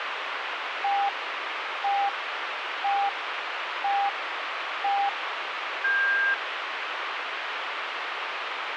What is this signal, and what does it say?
Radio time signal (five pips and a higher one, as on Chinese radio), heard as pips, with radio hiss.